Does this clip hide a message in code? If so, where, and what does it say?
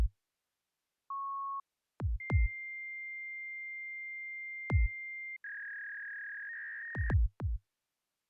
Yes: fax machine handshake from 1.1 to 7.1 s, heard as a beep, a long tone and a warble.